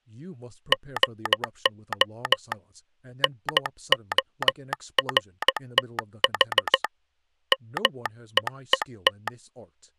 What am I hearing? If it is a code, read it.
Morse code, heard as a telegraph sounder, hand-sent with a straight key, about 14 wpm, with speech in English. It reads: GO NORTH MEET